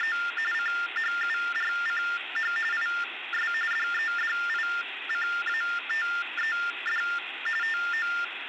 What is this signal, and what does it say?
TTY/TDD text telephone tones (45.45 baud Baudot), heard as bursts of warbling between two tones, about 400 Hz shift, 1600 Hz centre, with phone line noise. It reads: … CHURCH IS DEDICATED TO